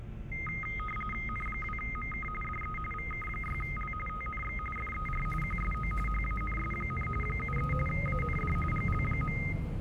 RTTY (45.45 baud, 850 Hz shift), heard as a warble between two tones, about 1700 Hz centre, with the noise inside a bus. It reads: N2MK DE VK6L TNX FER QSO HANS, 73 AND GL.